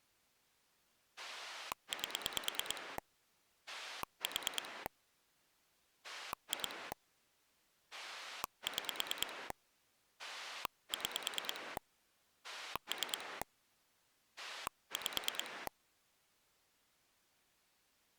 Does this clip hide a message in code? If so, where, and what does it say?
Yes: pulse dialling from 1.2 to 15.7 s, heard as a rotary dial, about 9 pulses a second. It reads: 8 4 2 6 6 3 5